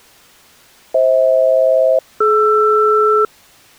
Aircraft SELCAL, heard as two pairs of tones. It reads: FH-DR